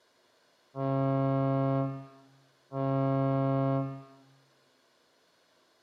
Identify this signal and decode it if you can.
Ship horn signal, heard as a ship's horn, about 140 Hz, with room echo. 2 short. At sea: I am altering course to port.